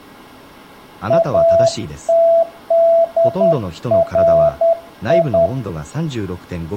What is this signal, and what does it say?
Morse code (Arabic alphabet), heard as a keyed tone, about 10 wpm, 670 Hz, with speech in Japanese. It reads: اتدري